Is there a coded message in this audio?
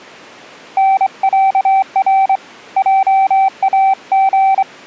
Yes: Morse code (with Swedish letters) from 0.7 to 4.7 s, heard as a keyed tone, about 24 wpm, 770 Hz. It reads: NÄR JAG